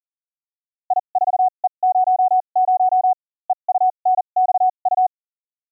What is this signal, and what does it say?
Morse code, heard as a keyed tone, machine-sent, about 40 wpm, spaced as for 31 wpm, 740 Hz. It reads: I4E00 EUNXU